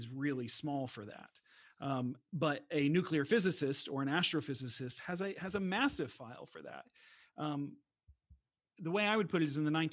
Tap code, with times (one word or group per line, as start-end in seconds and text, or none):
none